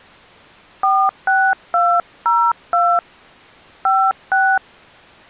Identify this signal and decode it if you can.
DTMF, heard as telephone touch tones, dialled by hand, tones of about 260 ms. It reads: 46202 56